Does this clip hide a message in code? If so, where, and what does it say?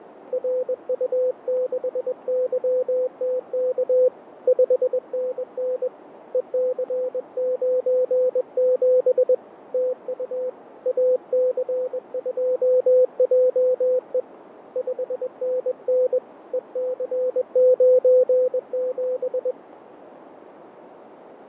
Yes: Morse code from 0.3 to 19.6 s, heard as a keyed tone, hand-sent with a paddle, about 21 wpm, 510 Hz, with radio static, fading and a narrow filter. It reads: RU6YTK 5NN EC97 TU AC2JE 5NN EC97